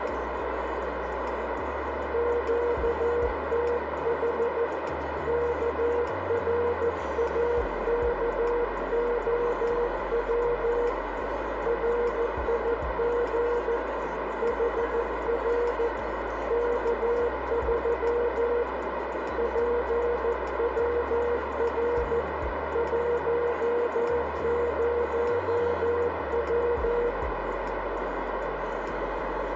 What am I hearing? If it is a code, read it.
Morse code, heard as a keyed tone, hand-sent with a paddle, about 14 wpm, 480 Hz, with heavy radio static and a narrow filter. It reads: QTH KRAKOW RIG HR K3 PWR 10W